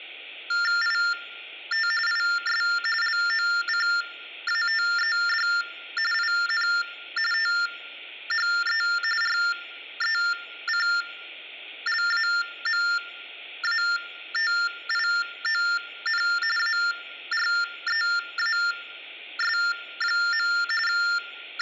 TTY/TDD text telephone tones (45.45 baud Baudot), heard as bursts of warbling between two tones, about 400 Hz shift, 1600 Hz centre. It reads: IT IS LOCATED IN THE RECLAMATION AREAS. …